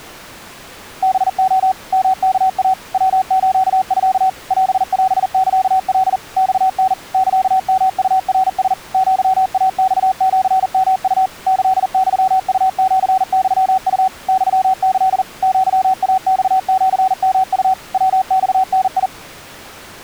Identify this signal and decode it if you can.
Morse code (Japanese Wabun code), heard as a keyed tone, machine-sent, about 40 wpm, 760 Hz. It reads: ハレ ヨワイ ヤスミ オオサカ マタ サヨウナラ アイマシヨウ キユウシユウ ユキ アイマシヨウ ヤマダ